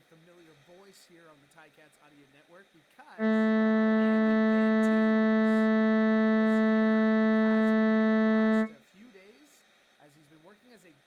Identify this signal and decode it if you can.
Ship horn signal, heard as a ship's horn, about 220 Hz, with speech in English. 1 long. At sea: a vessel nearing a blind bend, or under power and making way in fog.